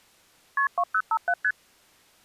Multi-frequency trunk signalling (R1, as on North American trunks), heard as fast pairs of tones, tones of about 60 ms. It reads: KP 2057 ST